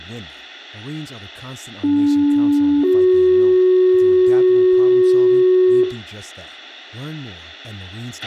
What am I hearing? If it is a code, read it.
Two-tone page, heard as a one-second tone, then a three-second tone, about 290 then 370 Hz, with a squelch burst at the end, room echo and speech in English.